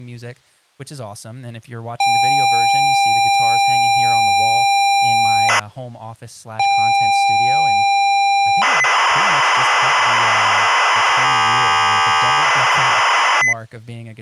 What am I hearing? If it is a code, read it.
ZX Spectrum tape loading, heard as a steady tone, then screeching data, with speech in English.